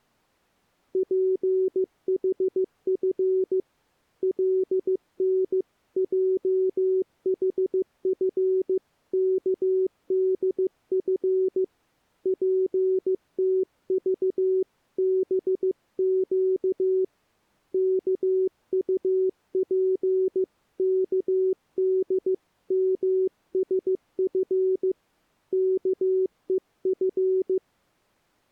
Morse code (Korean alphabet), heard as a keyed tone, hand-sent with a paddle, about 15 wpm, 380 Hz. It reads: 준 교훈은 절대 잊으면 안